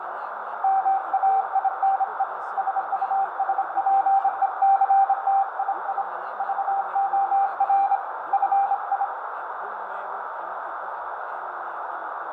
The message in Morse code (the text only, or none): MAINE SUSPECTII VOR FI